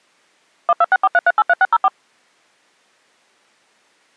DTMF, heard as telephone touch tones, dialled by machine, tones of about 40 ms. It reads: 12643383604